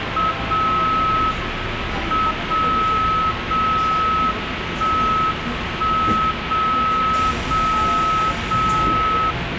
Radio time signal (WWVB), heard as a tone whose level steps once a second, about 1290 Hz, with radio static and the noise inside a subway train. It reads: 0 M 0 0 1 1 0 0 0